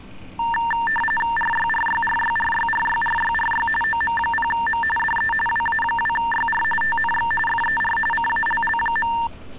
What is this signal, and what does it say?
RTTY (45.45 baud, 850 Hz shift), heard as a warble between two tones, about 1350 Hz centre, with street noise. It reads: RYRYRYRYRYRYRY OM0M DE WA2YR TNX FER CALL.